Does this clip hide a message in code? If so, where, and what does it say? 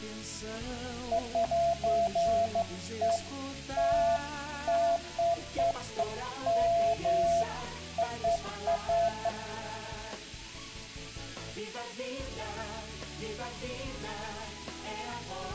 No, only beeps of irregular length, with room echo.